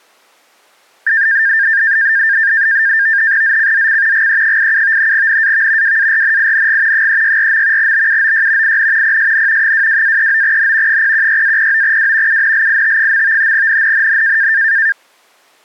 NAVTEX (SITOR-B), 100 baud, 170 Hz shift, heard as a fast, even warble, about 1700 Hz centre. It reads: ZCZC GE87 NAV WARNING 364. BUOY IN PSN 22-39N 016-09W UNLIT. NNNN